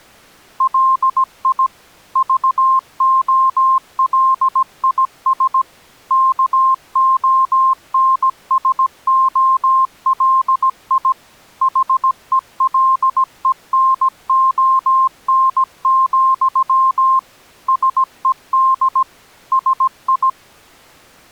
Morse code, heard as a keyed tone, machine-sent, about 17 wpm, 1060 Hz. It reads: LI VOLIS KONSOLI HELENON, SED SI